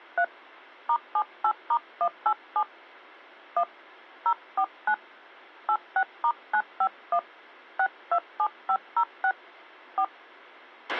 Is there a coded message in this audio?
Yes: DTMF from 0.2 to 10.0 s, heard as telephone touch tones, dialled by hand, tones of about 70 ms, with a squelch burst at the end. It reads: 3 *78*187 1 049 86*951 627506 4